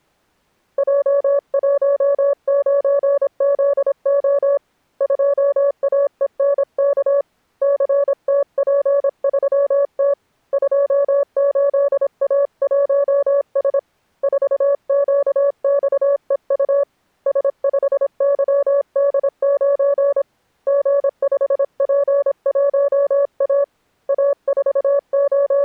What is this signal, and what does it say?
Morse code, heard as a keyed tone, hand-sent with a paddle, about 26 wpm, 560 Hz. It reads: J19ZO 2AENK CTP3T 28A1S 4QXEU S5YD9 G5P1A …